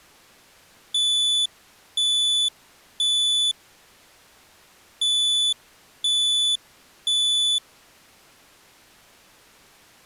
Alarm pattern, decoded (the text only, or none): temporal three